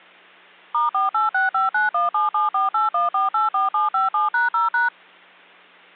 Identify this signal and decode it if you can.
DTMF, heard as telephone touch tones, dialled by machine, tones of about 150 ms, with hum. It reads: *48659177481484757#0#